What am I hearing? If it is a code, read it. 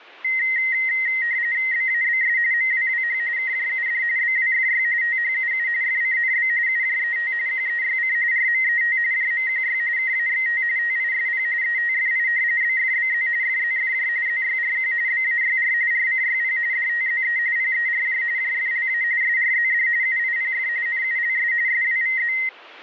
RTTY (45.45 baud, 170 Hz shift), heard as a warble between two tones, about 2000 Hz centre. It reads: BABS MWWH KJUD BWFY THUU FCNB UJET QEYC RMET JMQY KAXT TISP ETFI BFBZ FZFJ ZYRQ BAYR RCYP DTZE PERJ JFLA SRZD UIPF NULS SWVZ